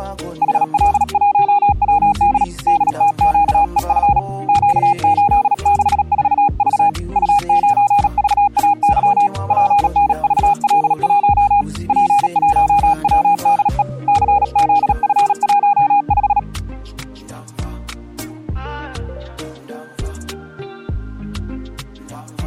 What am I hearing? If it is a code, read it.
Morse code, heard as a keyed tone, hand-sent with a paddle, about 37 wpm, 820 Hz. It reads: HL1WD DTQEF Q864V U9VAY PNVL1 P1WDE CZF15